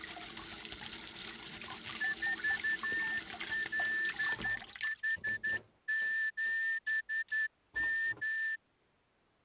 Morse code, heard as a whistle, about 11 wpm, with kitchen noise. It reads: 4LH7M